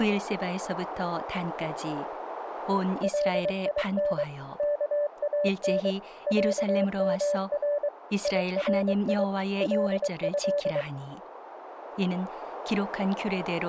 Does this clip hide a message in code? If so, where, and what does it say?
Yes: Morse code (Arabic alphabet) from 3.0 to 10.9 s, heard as a keyed tone, machine-sent, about 23 wpm, 580 Hz, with radio static and speech in Korean. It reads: لين كان عمر يري له